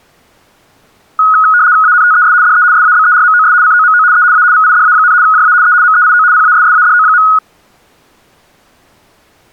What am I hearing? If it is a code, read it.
RTTY (75 baud, 170 Hz shift), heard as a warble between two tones, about 1360 Hz centre. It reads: ANTES DE SABERMOS COMO E A VIDA, JA E MEIO PASSADO.